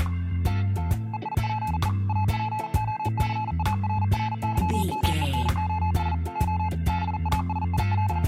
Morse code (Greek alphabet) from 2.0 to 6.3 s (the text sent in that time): ΑΠΟΘΑΡΡΥΜΕΝΟΣ